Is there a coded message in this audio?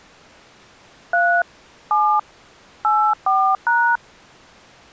Yes: DTMF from 1.1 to 4.0 s, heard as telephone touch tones, dialled by hand, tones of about 290 ms. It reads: 3 7 84#